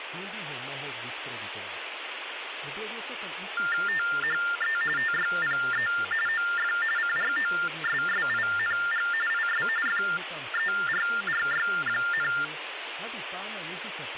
TTY/TDD text telephone tones (45.45 baud Baudot), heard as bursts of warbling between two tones, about 400 Hz shift, 1600 Hz centre, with phone line noise and speech in Slovak. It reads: THE TYPE OF CROSSING IS FERRY,